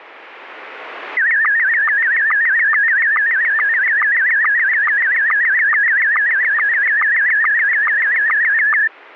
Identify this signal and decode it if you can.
SSTV (slow-scan television), Scottie S1, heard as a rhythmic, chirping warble, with radio static.